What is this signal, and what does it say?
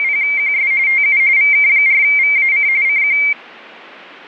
RTTY (45.45 baud, 170 Hz shift), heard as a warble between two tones, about 2200 Hz centre. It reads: … TU VK4VAC CQ